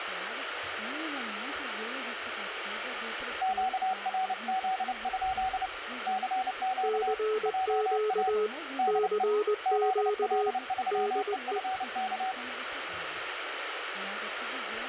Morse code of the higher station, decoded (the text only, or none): QRZ? CQ JA DE ZL3EFK